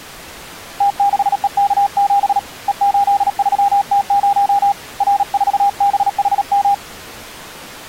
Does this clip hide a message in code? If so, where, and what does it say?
Yes: Morse code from 0.7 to 6.8 s, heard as a keyed tone, hand-sent with a paddle, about 37 wpm, 800 Hz. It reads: T6EK7 E83T0 R4BHM